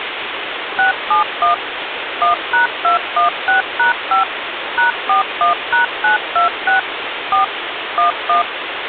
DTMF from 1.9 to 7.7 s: 1#216#5 #41#926 4

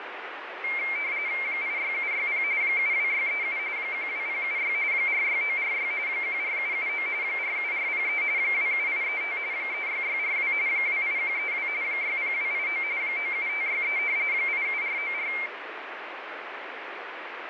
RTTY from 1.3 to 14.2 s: 86760 72637 12076 46946 14779 47403 27835 36642 28132 60289 97563

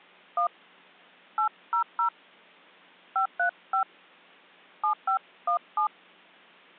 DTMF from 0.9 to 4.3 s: 800 535

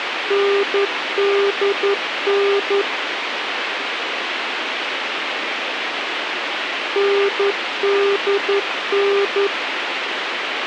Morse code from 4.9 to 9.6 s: NDN

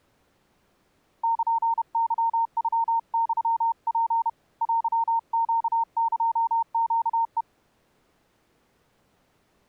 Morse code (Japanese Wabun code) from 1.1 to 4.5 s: ルケノユツ

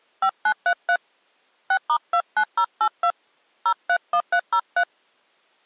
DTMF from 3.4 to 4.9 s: 031303

